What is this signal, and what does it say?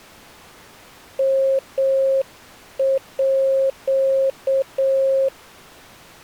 Morse code (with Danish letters), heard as a keyed tone, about 7 wpm, 540 Hz. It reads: MÅ